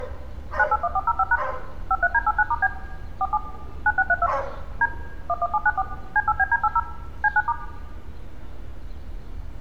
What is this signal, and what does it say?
DTMF, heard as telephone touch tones, dialled by machine, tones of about 50 ms, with room echo and street noise. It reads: 981405# 53D89*B 47 9632 D 11794 C8BD80 C9*